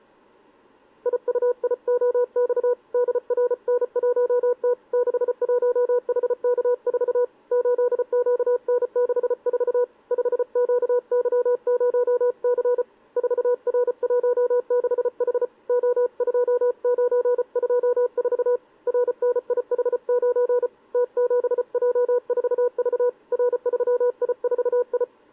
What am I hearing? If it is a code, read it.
Morse code, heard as a keyed tone, hand-sent with a paddle, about 34 wpm, 490 Hz. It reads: IUIOX DRN1T 61HK4 8QN64 5QY0C 4R16H O2924 RNIH9 T7J4V R3I4I